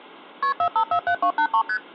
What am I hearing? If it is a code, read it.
Multi-frequency trunk signalling (R1, as on North American trunks), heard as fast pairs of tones, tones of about 80 ms. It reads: KP 4547283 ST